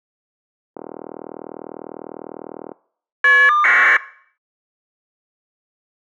Caller ID data burst, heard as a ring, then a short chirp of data, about 1200 baud.